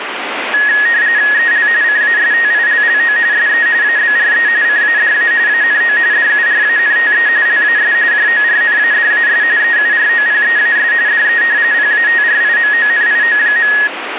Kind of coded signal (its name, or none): RTTY